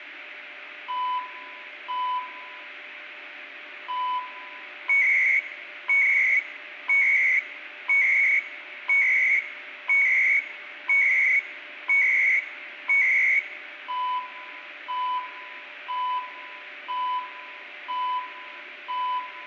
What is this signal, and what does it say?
Radio time signal (CHU, Canada), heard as beeps and data bursts, one a second, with radio static, a steady whistle near 600 Hz and room echo.